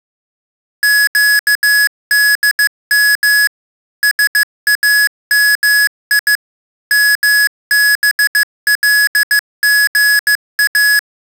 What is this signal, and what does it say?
Morse code (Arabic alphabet), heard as electronic beeps, machine-sent, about 15 wpm, 1700 Hz. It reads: قدم سامي مبلغا